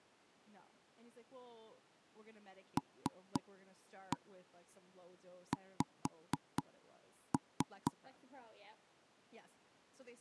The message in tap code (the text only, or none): LX